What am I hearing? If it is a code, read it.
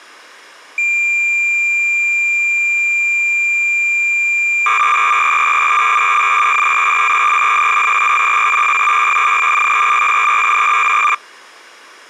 Cassette data (Kansas City type), 300 baud, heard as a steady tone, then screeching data.